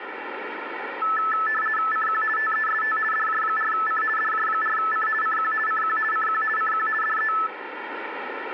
RTTY (50 baud, 450 Hz shift), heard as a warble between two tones, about 1550 Hz centre, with radio static. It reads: CQ TEST DJ4C DJ4C CQ CQ CQ CQ DE